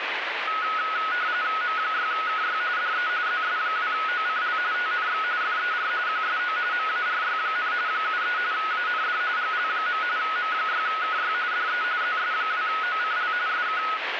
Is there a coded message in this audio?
Yes: RTTY (45.45 baud, 170 Hz shift) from 0.5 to 14.0 s, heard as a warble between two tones, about 1370 Hz centre, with radio static. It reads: M6KY DE ZS2OCL TNX FER QSO MARY, 73 AND GL. M6KY DE ZS2OCL SK